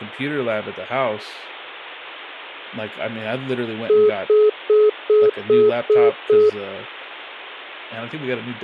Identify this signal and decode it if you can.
Telephone call progress tone (single-tone plan, as in most of Europe), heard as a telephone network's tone, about 420 Hz, 0.2 s on and 0.2 s off, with speech in English. Congestion tone.